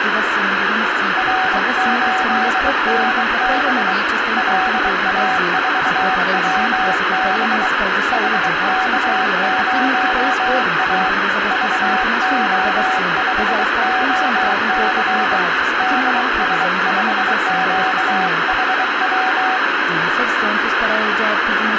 Morse code, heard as a keyed tone, hand-sent with a bug key, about 23 wpm, 750 Hz, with radio static. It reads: R8NB LA4WB HK0A VO5OC DS5QHW